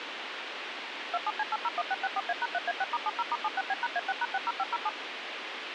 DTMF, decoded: 27C801664A#3A6*70*76B#A6#60507

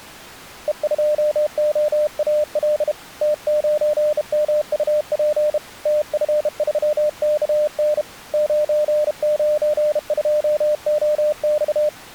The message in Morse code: E2OAL T9MUP TF3KN 992OX

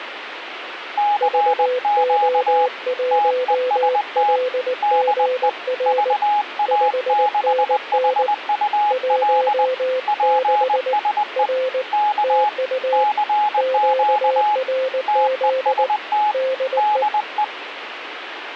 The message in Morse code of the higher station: CQ TEST DE VA6HUL PSE K CQ TEST DE

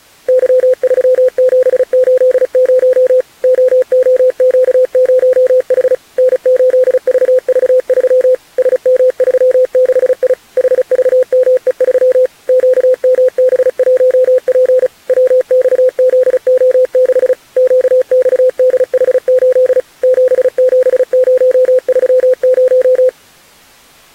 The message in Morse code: Y3780 OOQ0H N8VV3 SM36I HVME3 QMB1P WXZO6 QXDH8 77030

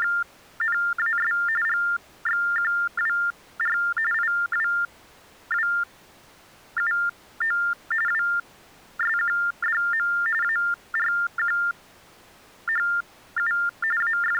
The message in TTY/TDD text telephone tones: … GXQWR IWWUO WSQDM ARQHU …

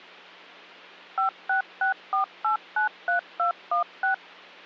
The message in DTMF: 5664893216

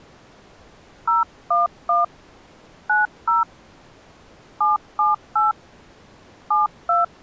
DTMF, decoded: 011 90 778 72

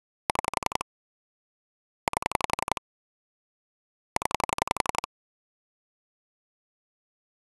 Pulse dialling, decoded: 6 8 0

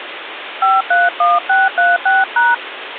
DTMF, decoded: 531636#

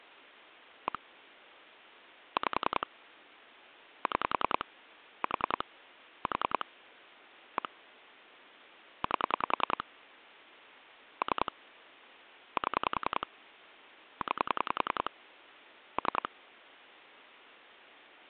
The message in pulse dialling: 1 5 6 4 4 1 8 3 7 9 3

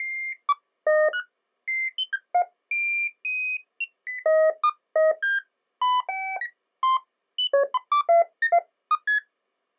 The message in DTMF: none

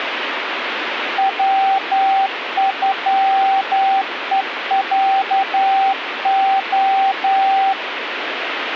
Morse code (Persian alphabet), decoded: وغهصع

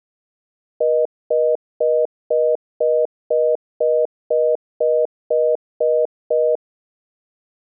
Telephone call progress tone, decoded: congestion tone

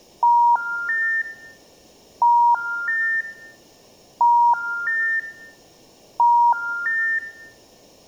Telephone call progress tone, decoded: special information tone

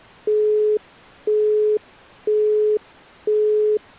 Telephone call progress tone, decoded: busy tone

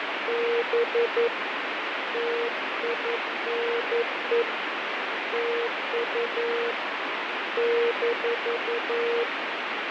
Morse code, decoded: … TINE TU -

